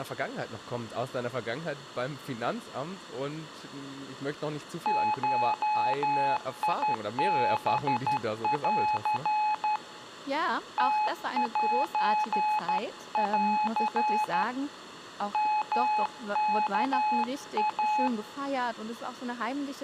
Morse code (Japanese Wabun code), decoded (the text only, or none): ゴハン ムセン ヨワイ